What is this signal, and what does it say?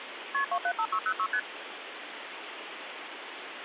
Multi-frequency trunk signalling (R1, as on North American trunks), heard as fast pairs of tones, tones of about 70 ms, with phone line noise. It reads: KP 275606 ST